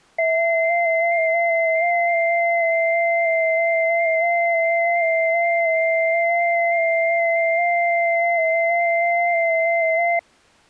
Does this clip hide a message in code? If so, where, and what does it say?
Yes: FT8 (several signals at once) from 0.2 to 10.2 s, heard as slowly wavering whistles, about 6.25 baud.